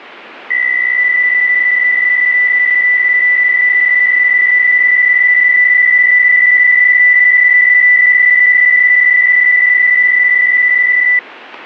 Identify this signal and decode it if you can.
PSK63 (62.5 baud), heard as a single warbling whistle, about 2000 Hz.